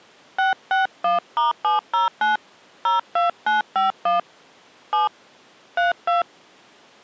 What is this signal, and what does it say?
DTMF, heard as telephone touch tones, dialled by hand, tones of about 140 ms. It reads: 661*709 02951 7 32